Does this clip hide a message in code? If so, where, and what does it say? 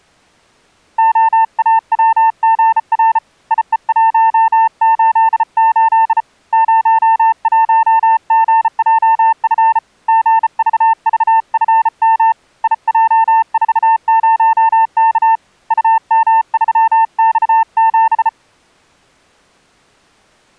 Yes: Morse code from 0.9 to 18.3 s, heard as a keyed tone, hand-sent with a bug key, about 34 wpm, 900 Hz. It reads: OAWGR IE188 01GJF GVVFM IJ40K UM3X7